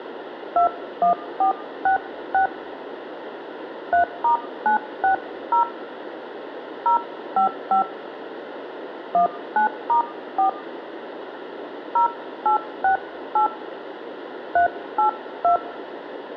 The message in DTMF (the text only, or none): 21466 3*960 055 19*4 0868 382